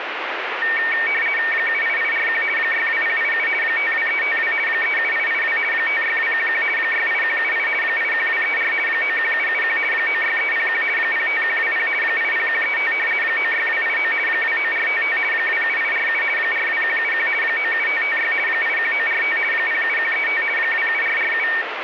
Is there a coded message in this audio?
Yes: RTTY (50 baud, 450 Hz shift) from 0.6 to 21.6 s, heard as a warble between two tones, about 2050 Hz centre, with radio static. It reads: 78841 62087 52352 37882 56211 68178 81234 91771 96301 05120 80135 96289 29455 27847 42171 97556 81945 07135 27447